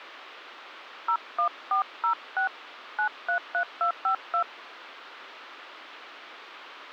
DTMF, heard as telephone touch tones, dialled by hand, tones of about 100 ms, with radio hiss. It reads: 01406 933252